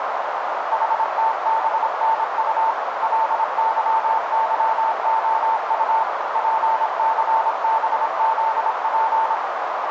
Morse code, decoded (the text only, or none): HTBNU LYYOU PCBZP